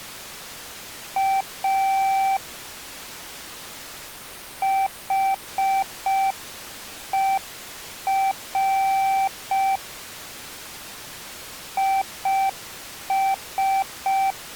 Morse code, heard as a keyed tone, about 5 wpm, 780 Hz. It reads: A HER IS